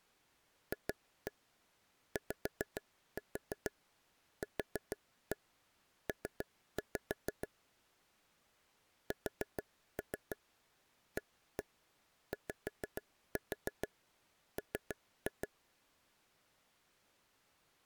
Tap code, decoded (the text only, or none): FYQP SAYM